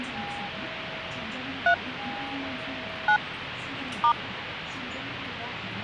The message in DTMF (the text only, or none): 3 9 *